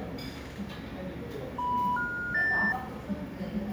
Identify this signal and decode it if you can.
Telephone call progress tone (North American plan), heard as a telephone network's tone, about 980, 1430, 1800 Hz, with room echo and the noise of a restaurant. Special information tone.